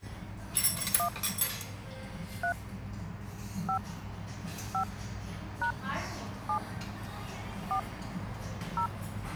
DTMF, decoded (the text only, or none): 1 3 5 5 # 7 4 0